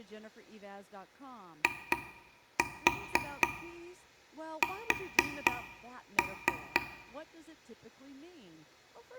Tap code, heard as taps on a table, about 4 knocks a second, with room echo and speech in English. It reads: IS